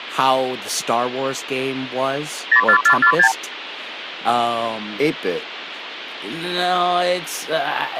Multi-frequency trunk signalling (R2, with the far end's replies), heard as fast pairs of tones, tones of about 80 ms, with phone line noise and speech in English. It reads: 04446